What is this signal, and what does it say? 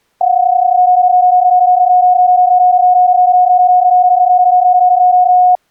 PSK31 (31.25 baud), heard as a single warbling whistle, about 730 Hz.